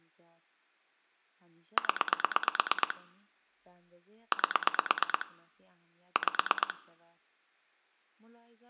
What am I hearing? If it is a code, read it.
Pulse dialling, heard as clicks on a phone line, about 8 pulses a second, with room echo and speech in Persian. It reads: 0 8 5